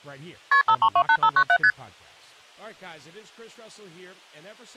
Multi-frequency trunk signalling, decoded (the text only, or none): KP 5328597 ST